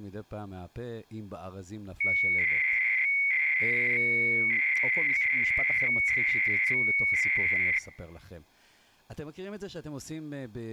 300-baud modem data (Bell 103 tones), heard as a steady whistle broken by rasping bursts, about 300 baud, 200 Hz shift.